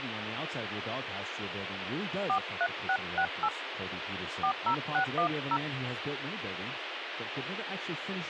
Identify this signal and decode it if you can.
DTMF, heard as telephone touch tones, dialled by hand, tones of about 70 ms, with radio hiss and speech in English. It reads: 43668 40610